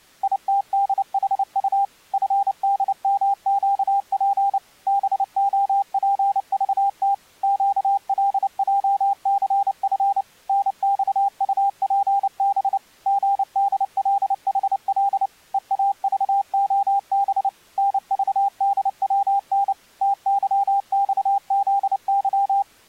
Morse code, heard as a keyed tone, machine-sent, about 29 wpm, 800 Hz. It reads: ITDHU FDMQP BOPVT QLJCF NXUPB GDLHL EAVOB NVDWN TYXZY